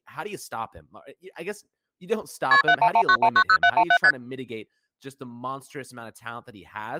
Multi-frequency trunk signalling (R1, as on North American trunks), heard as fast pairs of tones, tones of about 70 ms, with speech in English. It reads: KP 7119190717 ST